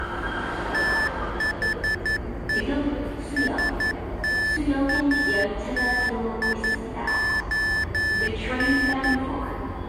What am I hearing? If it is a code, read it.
Morse code, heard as electronic beeps, machine-sent, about 11 wpm, 1750 Hz, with the noise of a subway station. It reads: THE STATION